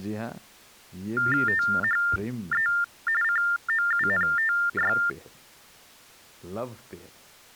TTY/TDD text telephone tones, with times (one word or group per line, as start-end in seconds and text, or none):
1.5-2.7 THE
3.2-5.0 COUNTY